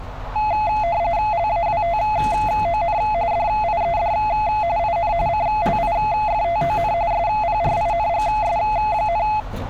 RTTY (45.45 baud, 170 Hz shift), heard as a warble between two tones, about 770 Hz centre, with radio static and street noise. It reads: LAWTON DIED IN CLIFTON SPRINGS,